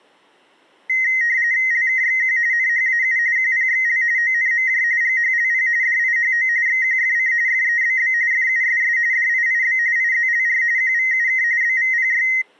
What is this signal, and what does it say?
RTTY (45.45 baud, 170 Hz shift), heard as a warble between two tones, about 1950 Hz centre. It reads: LKXQ NHAU QPXL ONMJ GHLP DIHO XQFC FEBB FUSS DIIB IZLR QVUK BVPY